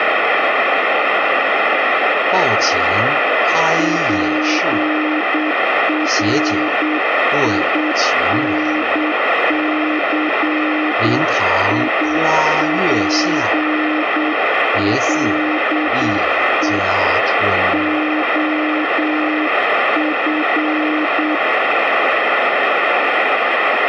Morse code, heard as a keyed tone, hand-sent with a paddle, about 8 wpm, 310 Hz, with radio static. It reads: PRINCIPLE OF